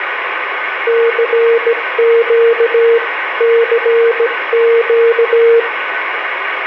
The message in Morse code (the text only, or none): CQ CQ